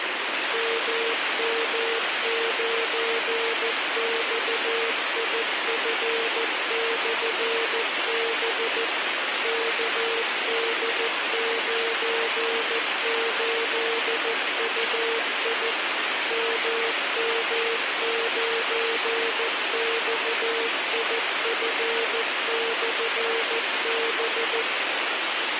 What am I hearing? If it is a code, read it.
Morse code, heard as a keyed tone, machine-sent, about 14 wpm, 460 Hz, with radio hiss. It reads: MM9XIF/B KD98UI MM9XIF/B